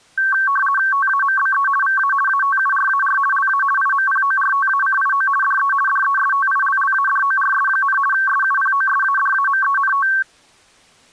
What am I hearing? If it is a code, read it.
RTTY (50 baud, 450 Hz shift), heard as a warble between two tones, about 1340 Hz centre. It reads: TAMBE VA ATURAR LA IMPORTACIO DE DESTILLADORS, SUPOSADAMENT